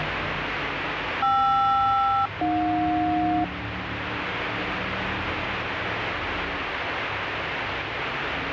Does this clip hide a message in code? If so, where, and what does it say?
Yes: aircraft SELCAL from 1.2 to 3.4 s, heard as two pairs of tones, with radio static and street noise. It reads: KR-AJ